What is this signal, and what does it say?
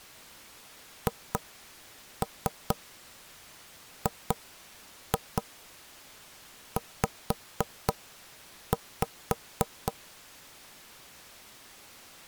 Tap code, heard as knocks on wood, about 4 knocks a second. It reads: HGZ